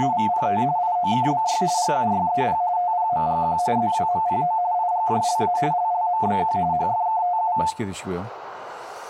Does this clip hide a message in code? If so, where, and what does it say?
Yes: RTTY (45.45 baud, 170 Hz shift) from 0.0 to 7.7 s, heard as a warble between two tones, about 800 Hz centre, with room echo and speech in Korean. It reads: … IOKBY GUYEP TPMGQ ZWMPO IGJLA LLMBQ HFKTU